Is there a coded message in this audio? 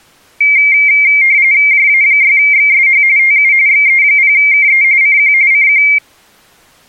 Yes: RTTY (45.45 baud, 170 Hz shift) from 0.4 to 6.0 s, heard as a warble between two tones, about 2200 Hz centre. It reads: JA6XSH TU XE0KE CQ CQ